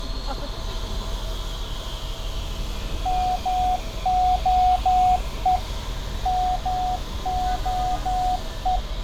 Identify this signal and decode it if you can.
Morse code, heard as a keyed tone, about 12 wpm, 730 Hz, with street noise. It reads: MOE MOE